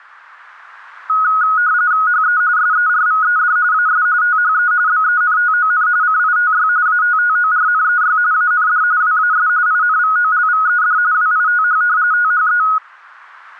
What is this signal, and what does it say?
RTTY (45.45 baud, 170 Hz shift), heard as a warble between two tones, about 1360 Hz centre. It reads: HE SERVED AS THE BENTON CITY ATTORNEY AND WAS INVOLVED WITH THE